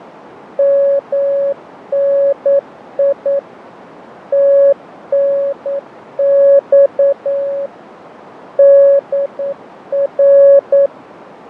Morse code, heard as a keyed tone, machine-sent, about 9 wpm, 560 Hz, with radio static, fading and a narrow filter. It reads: MNI TNX DR